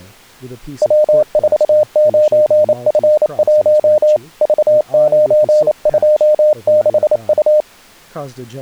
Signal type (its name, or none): Morse code